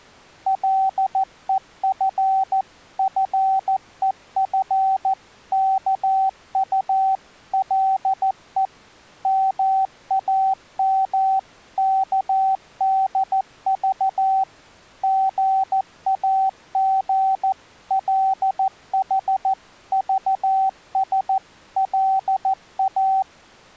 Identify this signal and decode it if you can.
Morse code (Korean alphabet), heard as a keyed tone, machine-sent, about 14 wpm, 770 Hz. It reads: 간난이가 몸을 솟구려고